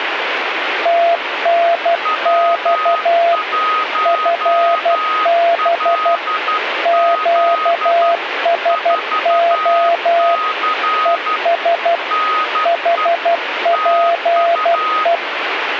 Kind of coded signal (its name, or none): Morse code